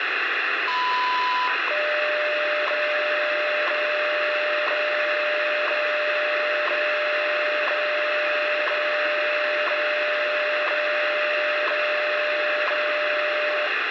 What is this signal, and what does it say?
Radio time signal (WWV, Colorado), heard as ticks, one a second, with radio static.